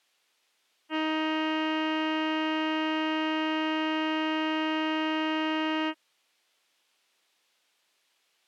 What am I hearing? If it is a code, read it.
Ship horn signal, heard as a ship's horn, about 310 Hz. 1 long. At sea: a vessel nearing a blind bend, or under power and making way in fog.